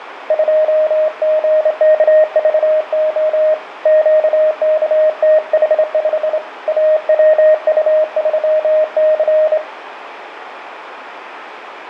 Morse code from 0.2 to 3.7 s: 2GKVO

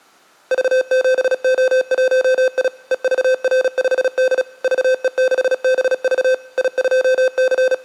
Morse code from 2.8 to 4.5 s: EVR5D

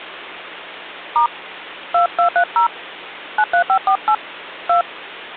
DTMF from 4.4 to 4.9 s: 2

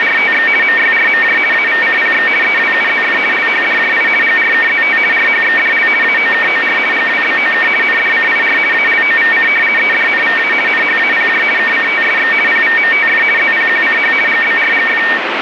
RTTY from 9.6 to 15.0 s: EDNVA NHAPJ KCTSX PVMTF ZPQCH GBRGF

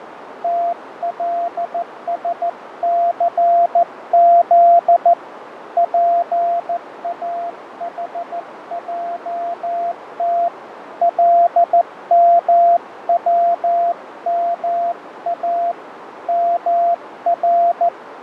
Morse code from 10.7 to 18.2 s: LMWMA …

